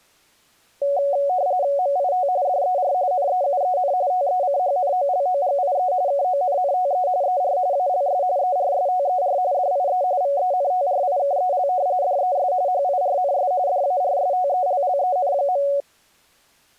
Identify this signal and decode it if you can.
RTTY (45.45 baud, 170 Hz shift), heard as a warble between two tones, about 650 Hz centre. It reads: MIT DER NEUEN TECHNOLOGIE KONNTE ER ALS ERSTER DIE VENTRIKEL DES HIRNS DARSTELLEN.